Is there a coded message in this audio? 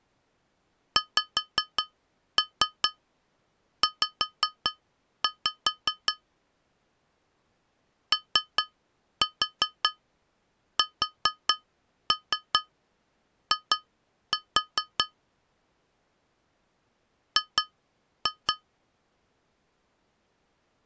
Yes: tap code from 1.0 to 18.6 s, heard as taps on glass, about 5 knocks a second. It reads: XZ OSI G